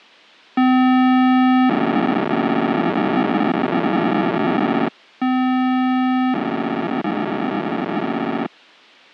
POCSAG pager data (512 baud), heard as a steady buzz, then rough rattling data.